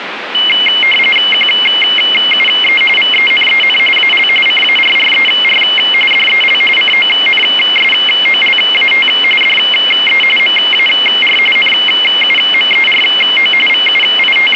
RTTY (45.45 baud, 850 Hz shift), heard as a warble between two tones, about 2550 Hz centre, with radio static. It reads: QUE VENEN AL CARRER DEL CONSOLAT DE MAR NUMERO …